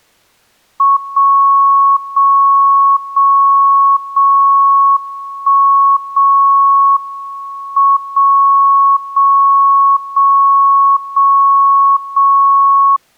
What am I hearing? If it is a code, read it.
Radio time signal (WWVB), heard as a tone whose level steps once a second, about 1100 Hz. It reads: 0 0 0 0 1 0 M 0 0 0 0 0